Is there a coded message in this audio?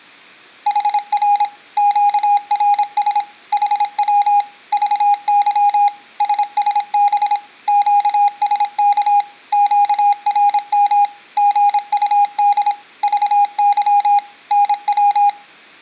Yes: Morse code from 0.6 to 15.4 s, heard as a keyed tone, machine-sent, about 26 wpm, 820 Hz. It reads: HR QRS HW VY SSB QSK QRM GUD VY NW